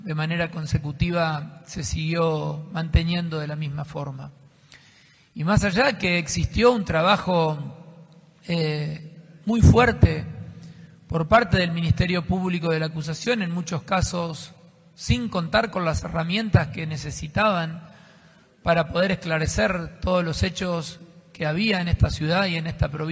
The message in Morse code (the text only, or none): none